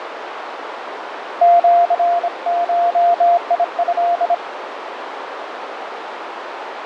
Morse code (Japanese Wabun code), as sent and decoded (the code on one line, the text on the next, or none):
--.-. ---- .. ..-..
シゴト